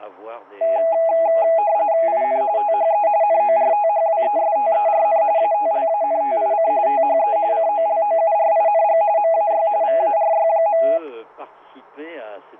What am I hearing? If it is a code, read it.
RTTY (45.45 baud, 170 Hz shift), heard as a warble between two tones, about 740 Hz centre. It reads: IN THE NORTHWESTERN ATLANTIC THE COLOURING MAY VARY.